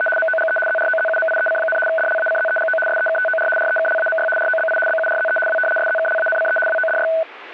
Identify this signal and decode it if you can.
RTTY (75 baud, 850 Hz shift), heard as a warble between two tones, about 1070 Hz centre. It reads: … MOGE ZROZUMIEC, DLACZEGO SEKTOR REKLAMY ROBI BURZE W SZKLANCE WODY